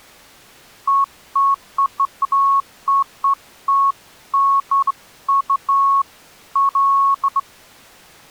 Beeps of irregular length. There is no code.